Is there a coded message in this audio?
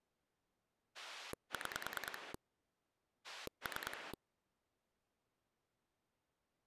Yes: pulse dialling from 0.9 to 4.1 s, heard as a rotary dial, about 9 pulses a second. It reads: 6 3